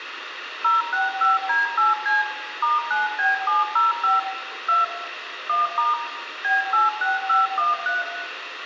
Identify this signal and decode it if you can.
DTMF, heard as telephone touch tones, dialled by machine, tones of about 160 ms, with phone line noise and room echo. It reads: 065D8C *9B705 2 1* B86513